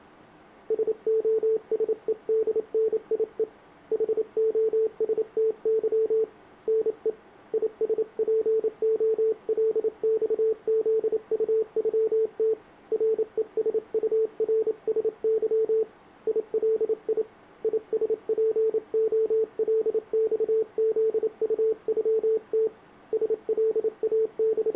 Morse code (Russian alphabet), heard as a keyed tone, hand-sent with a paddle, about 28 wpm, 440 Hz. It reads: СОСЕДНИЕ ХОСТЫ НЕ ИСПОЛЬЗУЮТ РЕСУРСЫ ИЛИ ИСПОЛЬЗУЮТ …